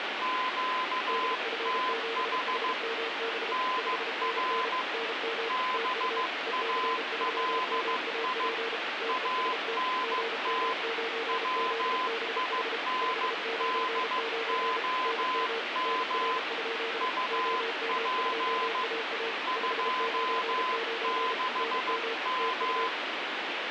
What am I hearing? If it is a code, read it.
Morse code, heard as two keyed tones, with heavy radio static. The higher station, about 15 wpm, 1020 Hz: QTH NR BALI ANT WINDOM UP 26M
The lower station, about 33 wpm, 460 Hz: DF7HMB 5NN NM TU EC3MAP TEST GM9ZBH 599 NM NR? OM2AA 599 NM TU